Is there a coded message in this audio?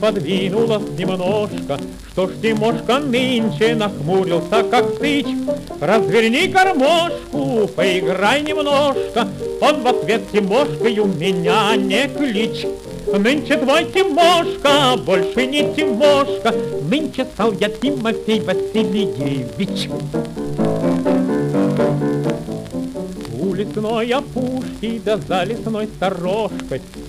No.